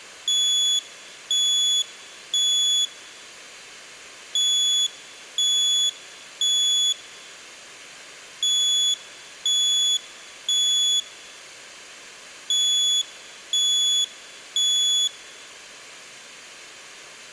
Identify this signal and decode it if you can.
Alarm pattern, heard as an alarm's beeps, played four times, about 3400 Hz. Temporal three. Smoke or fire, evacuate.